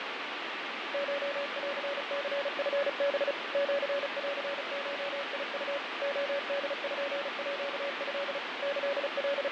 Morse code (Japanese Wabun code), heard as a keyed tone, machine-sent, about 35 wpm, 560 Hz, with heavy radio static and fading. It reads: コンニチハ シンゴウ レポート …